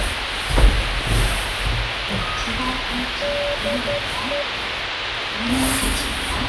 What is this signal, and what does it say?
Morse code, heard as a keyed tone, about 11 wpm, 580 Hz, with radio hiss and the noise inside a lift. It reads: DE